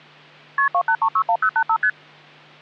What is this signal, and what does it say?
Multi-frequency trunk signalling (R1, as on North American trunks), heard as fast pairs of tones, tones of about 70 ms, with hum. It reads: KP 28361085 ST